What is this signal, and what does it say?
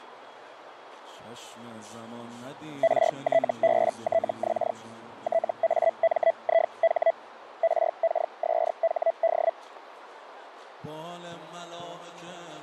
Hellschreiber (Feld-Hell, 122.5 baud), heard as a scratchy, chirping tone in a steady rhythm, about 660 Hz, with radio static. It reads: RTBTX TAMIH RKSHD